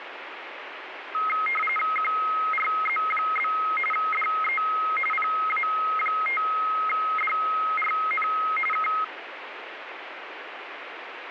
RTTY (45.45 baud, 850 Hz shift), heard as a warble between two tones, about 1700 Hz centre, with radio static. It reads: QRZ? DE PA5DRN K